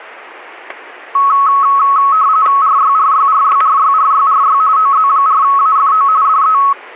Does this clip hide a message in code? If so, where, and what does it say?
Yes: RTTY (45.45 baud, 170 Hz shift) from 1.1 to 6.7 s, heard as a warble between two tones, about 1200 Hz centre, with static crashes. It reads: RYRYRYRYRYRY OZ4AFO DE